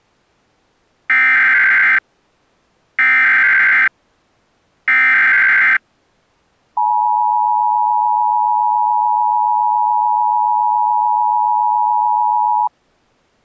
Emergency Alert System (SAME) tones (header bursts, then the 853 and 960 Hz attention tone), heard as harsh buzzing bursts, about 520.83 baud.